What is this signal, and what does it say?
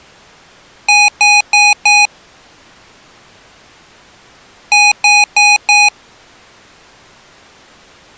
Beep code, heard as beeps from a small speaker, played twice, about 830 Hz. 4 short. In AMI BIOS tables: system timer failure; in Dell tables: memory read or write failure.